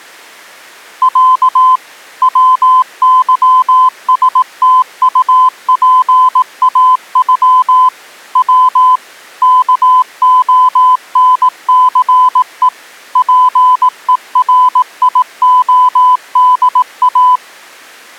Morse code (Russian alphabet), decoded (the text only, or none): Я ВЫСТУПАЮ В КОНЦЕ ПЕРИОДА